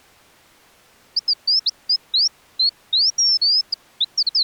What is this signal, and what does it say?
Bird-like chirps. There is no code.